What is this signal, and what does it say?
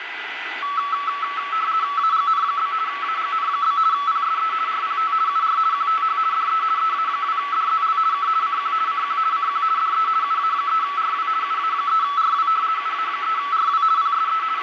RTTY (50 baud, 170 Hz shift), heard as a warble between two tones, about 1220 Hz centre, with radio static, a steady whistle near 2000 Hz and room echo. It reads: AGN? AGN? PSE RPT UR QTH DE EA2DZL K CQ CQ CQ DE UA3RW UA3RW UA3RW PSE …